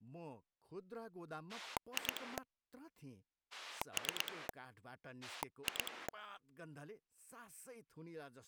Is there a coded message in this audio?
Yes: pulse dialling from 1.5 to 6.1 s, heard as a rotary dial, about 9 pulses a second, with speech in Nepali. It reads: 2 3 2